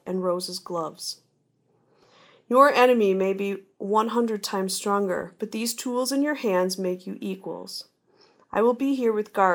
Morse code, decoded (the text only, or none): none